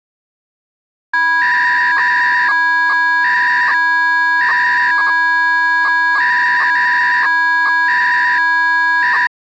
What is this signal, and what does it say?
300-baud modem data (V.21 tones), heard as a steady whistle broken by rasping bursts, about 300 baud, 200 Hz shift.